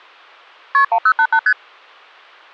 Multi-frequency trunk signalling (R1, as on North American trunks), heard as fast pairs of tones, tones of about 70 ms. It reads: KP 1088 ST